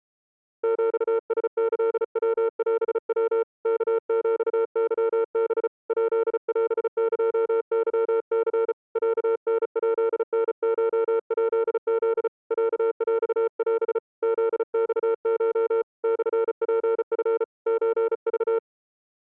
Morse code (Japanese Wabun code), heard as a keyed tone, hand-sent with a paddle, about 35 wpm, 450 Hz. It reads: ヒラキヤオヤ ワヒケハ ヱオエケニ ロタヱタコヱフ ロヰオ フマコ モツチ ソク